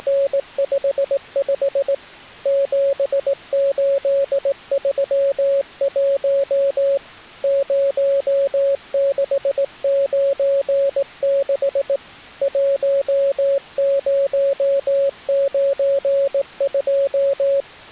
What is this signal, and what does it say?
Morse code, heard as a keyed tone, hand-sent with a straight key, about 18 wpm, 550 Hz. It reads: … 7831 0696 1092